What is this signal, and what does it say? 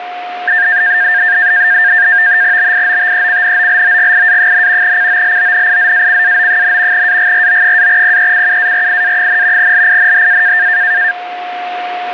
NAVTEX (SITOR-B), 100 baud, 170 Hz shift, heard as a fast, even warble, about 1700 Hz centre, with a steady whistle near 720 Hz. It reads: BIOTECNOLOGIA, COLONIZACAO, AGRO-PECUARIA, LINHA